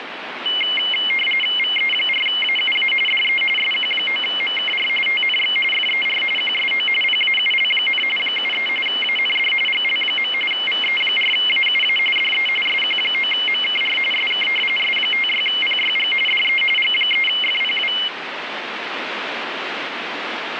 RTTY (45.45 baud, 850 Hz shift), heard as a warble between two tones, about 2550 Hz centre, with radio static. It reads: VE4AUA DE SQ9MKR TNX FER QSO PAUL, 73 AND GL. VE4AUA DE SQ9MKR SK S56PYG DE G3FPW